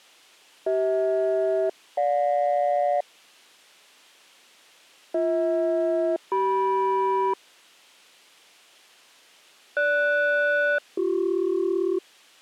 Aircraft SELCAL, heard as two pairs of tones. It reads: CH-GJ BH-CM GS-BC